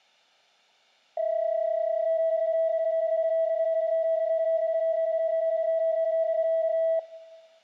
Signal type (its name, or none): PSK31